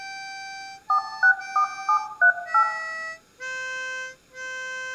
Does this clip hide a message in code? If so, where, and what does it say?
Yes: DTMF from 0.9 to 2.6 s, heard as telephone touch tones, dialled by machine, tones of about 90 ms, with room echo. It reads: 464738